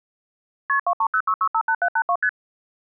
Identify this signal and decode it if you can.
Multi-frequency trunk signalling (R1, as on North American trunks), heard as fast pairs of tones, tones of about 70 ms. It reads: KP 2306658782 ST